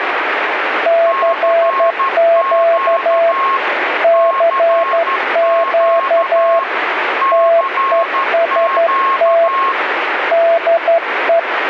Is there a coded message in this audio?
Yes: Morse code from 0.8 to 11.5 s, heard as two keyed tones, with radio static. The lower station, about 12 wpm, 670 Hz: CQ CQ TEST DE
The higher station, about 13 wpm, 1080 Hz: CQ CQ CQ